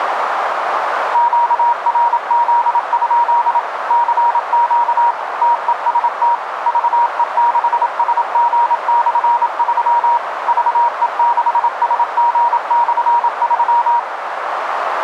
Morse code, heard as a keyed tone, machine-sent, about 27 wpm, 950 Hz, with radio static and a narrow filter. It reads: QRZ? CQ TEST VE6SG/3 VE6SG/3